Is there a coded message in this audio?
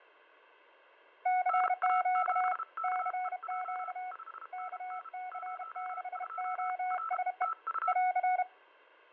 Yes: Morse code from 1.2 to 8.5 s, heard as two keyed tones, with fading. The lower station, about 31 wpm, 740 Hz: CQ CQ KC6OSE <AR>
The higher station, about 32 wpm, 1320 Hz: NA7KEJ 5NN 02 R TU